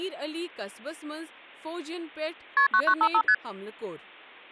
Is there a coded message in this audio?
Yes: multi-frequency trunk signalling (R1, as on North American trunks) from 2.6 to 3.3 s, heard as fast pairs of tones, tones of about 70 ms, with speech in Kashmiri. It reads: KP 9955 ST